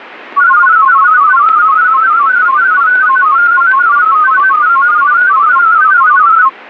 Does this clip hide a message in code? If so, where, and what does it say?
Yes: multi-tone FSK (Olivia or MFSK type), about 500 Hz wide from 0.4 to 6.5 s, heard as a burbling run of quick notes, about 31.25 baud.